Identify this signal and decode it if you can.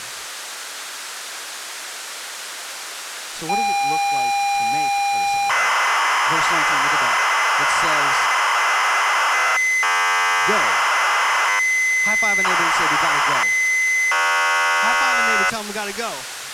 ZX Spectrum tape loading, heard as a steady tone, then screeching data, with tape hiss and speech in English.